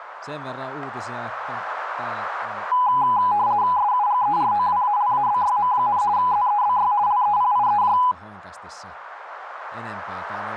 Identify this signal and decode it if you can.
RTTY (50 baud, 170 Hz shift), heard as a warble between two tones, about 910 Hz centre, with radio static and speech in Finnish. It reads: SUGEROWALABYM, ZEBY LEPIEJ